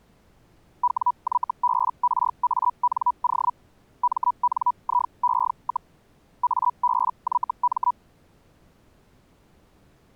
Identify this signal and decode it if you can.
Hellschreiber (Feld-Hell, 122.5 baud), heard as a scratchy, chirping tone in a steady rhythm, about 980 Hz. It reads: WYBRANO MNIE, ABYM